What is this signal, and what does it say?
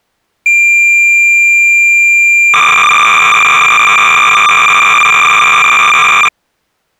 Cassette data (Kansas City type), 300 baud, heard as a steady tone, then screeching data.